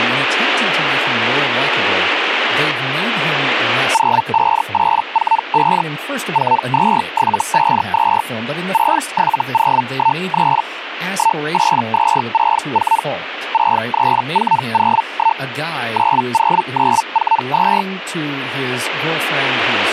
Hellschreiber (Feld-Hell, 122.5 baud), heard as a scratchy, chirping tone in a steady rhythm, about 900 Hz, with speech in English. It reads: 05845 42752 67013 18264 63401 90942